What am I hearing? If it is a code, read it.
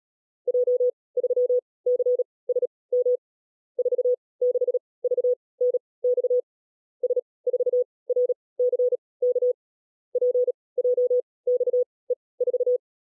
Morse code, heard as a keyed tone, machine-sent, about 37 wpm, spaced as for 22 wpm, 500 Hz. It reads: J3CSM 46VNX S4RCK PJXE4